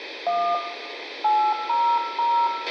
DTMF, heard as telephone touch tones, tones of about 290 ms, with radio hiss, a squelch burst at the end and room echo. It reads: 1 800